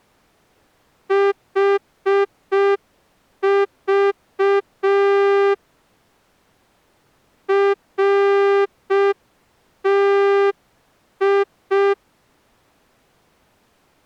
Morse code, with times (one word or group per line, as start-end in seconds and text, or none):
1.1-5.5 HV
7.5-11.9 RTI